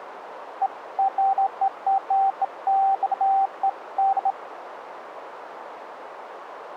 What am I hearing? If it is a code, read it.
Beeps of irregular length, with radio static. There is no code.